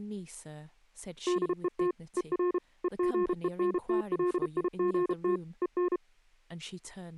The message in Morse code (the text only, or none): DET ER EGENTLIGT EN